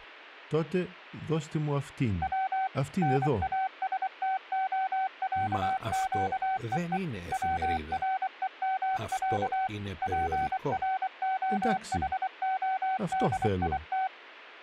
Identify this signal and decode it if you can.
Morse code (Russian alphabet), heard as a keyed tone, machine-sent, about 24 wpm, 760 Hz. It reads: В НАСТОЯЩЕЕ ВРЕМЯ ПРОХОДИТ